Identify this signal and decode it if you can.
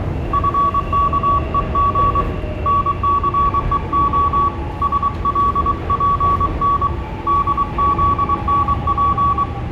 Morse code, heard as a keyed tone, hand-sent with a paddle, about 23 wpm, 1130 Hz, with room echo and the noise inside a subway train. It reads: FKEG NCEO SLPN DZNP